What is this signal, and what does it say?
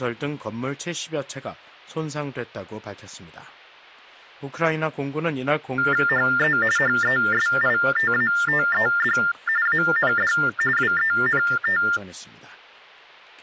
TTY/TDD text telephone tones (45.45 baud Baudot), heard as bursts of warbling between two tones, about 400 Hz shift, 1600 Hz centre. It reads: HE HESITATED AND WENT